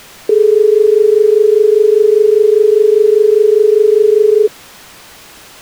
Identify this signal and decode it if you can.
Telephone call progress tone (as in Australia), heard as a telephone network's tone, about 430 Hz. Dial tone.